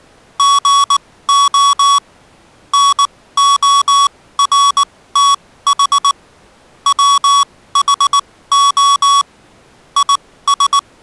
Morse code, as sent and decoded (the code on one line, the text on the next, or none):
--. --- / -. --- .-. - .... / .-- .... --- / .. ...
GO NORTH WHO IS